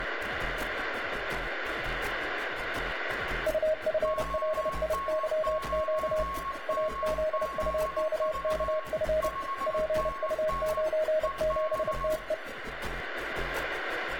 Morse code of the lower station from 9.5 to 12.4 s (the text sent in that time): PU97TE